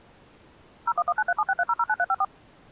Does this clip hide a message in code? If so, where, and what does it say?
Yes: DTMF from 0.9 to 2.2 s, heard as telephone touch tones, dialled by machine, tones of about 50 ms. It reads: 01193763009354